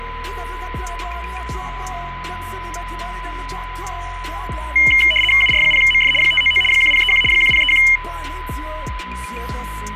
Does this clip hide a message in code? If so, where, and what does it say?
Yes: RTTY (75 baud, 850 Hz shift) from 4.8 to 8.0 s, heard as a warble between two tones, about 2550 Hz centre, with a steady whistle near 1000 Hz. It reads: UR0MF 599 1031 1031